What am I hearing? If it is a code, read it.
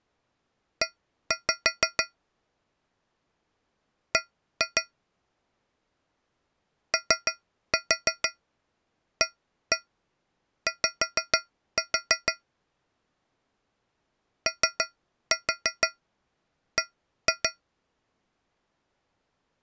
Tap code, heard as taps on a metal pipe, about 6 knocks a second. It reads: E B OAY OB